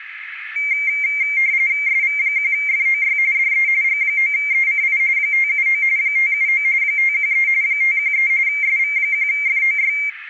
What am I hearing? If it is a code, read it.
RTTY (45.45 baud, 170 Hz shift), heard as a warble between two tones, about 2200 Hz centre, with radio static. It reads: SV1FOY DE G9ECI 579 579 513 513 SV1FOY